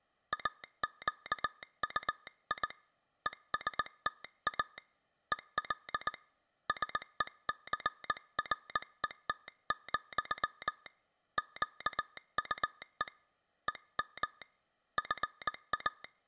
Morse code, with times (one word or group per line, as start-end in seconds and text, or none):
0.3-2.7 AQUI
3.3-4.8 ESTA
5.3-6.1 EL
6.7-10.9 SECRET,
11.4-13.1 QUE
13.7-14.4 EM
15.0-16.0 FA